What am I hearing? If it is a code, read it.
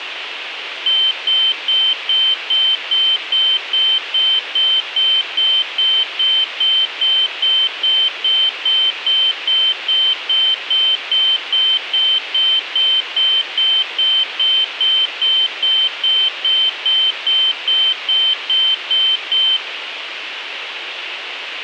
Evenly repeated beeps, with radio hiss. There is no code.